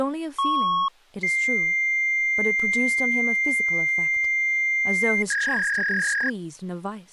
Fax machine handshake, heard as a beep, a long tone and a warble, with speech in English.